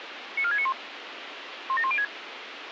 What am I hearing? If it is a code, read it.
Five-tone selective call (ZVEI), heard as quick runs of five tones, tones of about 70 ms, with radio hiss. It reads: 94691 17106